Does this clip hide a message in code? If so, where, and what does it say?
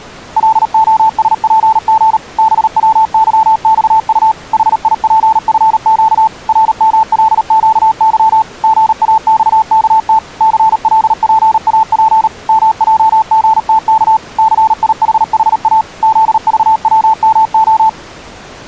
Yes: Morse code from 0.3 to 18.0 s, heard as a keyed tone, machine-sent, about 38 wpm, 880 Hz. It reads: LOSPG BWYXU HIPFQ RMLQY GAXKT CLPAP MJGTK CIHHA ZVWMO